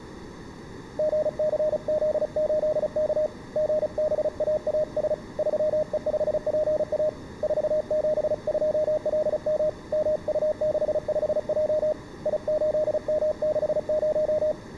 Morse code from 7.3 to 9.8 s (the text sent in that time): 472LM